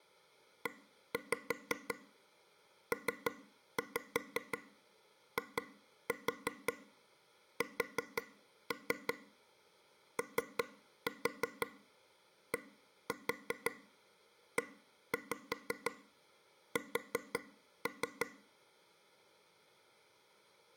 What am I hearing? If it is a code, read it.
Tap code, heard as taps on a table, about 5 knocks a second. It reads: EPISODES